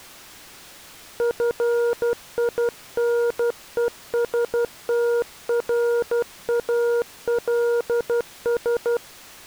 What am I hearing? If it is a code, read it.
Morse code, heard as a keyed tone, hand-sent with a paddle, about 12 wpm, 470 Hz. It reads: FINESTRALS